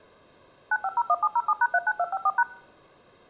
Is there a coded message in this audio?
Yes: DTMF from 0.7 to 2.4 s, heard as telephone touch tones, dialled by machine, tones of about 50 ms. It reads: 9501707#39254#